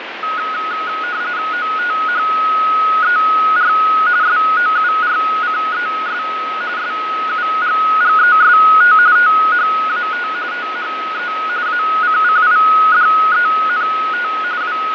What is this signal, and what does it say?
RTTY (45.45 baud, 170 Hz shift), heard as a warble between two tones, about 1360 Hz centre, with radio static and fading. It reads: OTHER SOURCES SUGGEST THAT THE ACCIDENT …